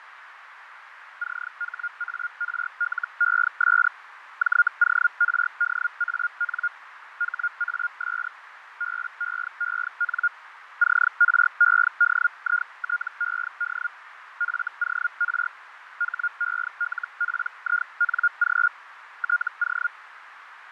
Hellschreiber (Feld-Hell, 122.5 baud), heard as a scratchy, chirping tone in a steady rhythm, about 1420 Hz, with radio static, fading and a narrow filter. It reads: CHARLES JORDAN HAS BEEN CREDITED FOR HELPING TO